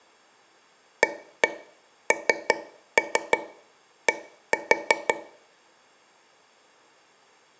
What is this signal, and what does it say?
Tap code, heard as taps on a table, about 5 knocks a second, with room echo. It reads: AND